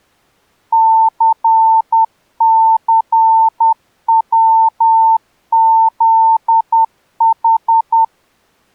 Morse code, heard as a keyed tone, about 10 wpm, 900 Hz. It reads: CCWZH